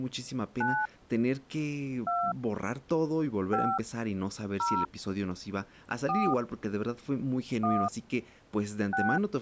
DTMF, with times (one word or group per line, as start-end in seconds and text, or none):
0.6-0.9 9
2.1-2.3 2
3.5-3.8 5
4.6-4.9 0
6.1-6.3 4
7.6-7.9 1
8.9-9.2 6